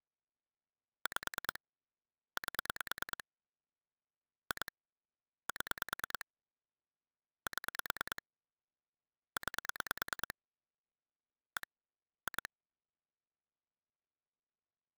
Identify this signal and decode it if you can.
Pulse dialling, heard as clicks on a phone line, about 9 pulses a second. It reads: 5 8 2 7 7 9 1 2